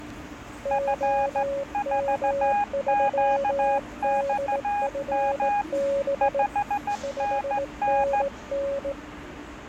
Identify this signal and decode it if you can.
Morse code, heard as two keyed tones, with the noise of a subway station. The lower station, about 18 wpm, 560 Hz: OM3DFB 5NN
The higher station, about 15 wpm, 820 Hz: F4QXM 5NN